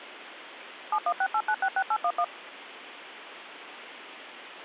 DTMF, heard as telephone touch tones, dialled by machine, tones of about 60 ms, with phone line noise. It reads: 7168966811